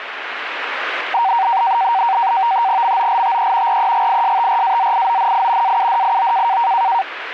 NAVTEX (SITOR-B), 100 baud, 170 Hz shift, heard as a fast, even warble, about 850 Hz centre, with radio static. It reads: MOLTE REGISTRAZIONI AUDIO